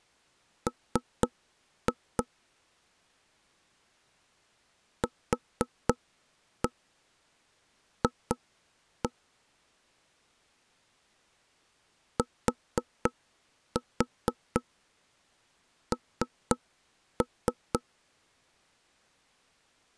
Tap code, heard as knocks on wood, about 4 knocks a second. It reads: M QF TN